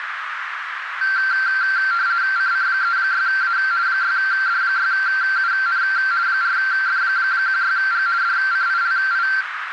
RTTY (50 baud, 170 Hz shift), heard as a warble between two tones, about 1460 Hz centre, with radio static and a narrow filter. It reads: CC36A 6D6UN 4F16G DCILI